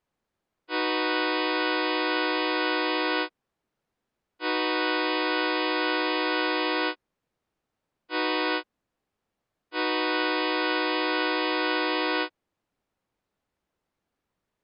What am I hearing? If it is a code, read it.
Train horn signal, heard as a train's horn. 2 long, 1 short, 1 long. On North American railways: approaching a public crossing.